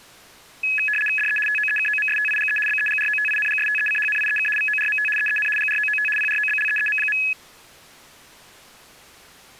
RTTY (75 baud, 850 Hz shift), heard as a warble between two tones, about 2100 Hz centre. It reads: DE TOEKOMSTIGE BEGROTINGSTECHNIEK VORMT EEN GROOT PROBLEEM.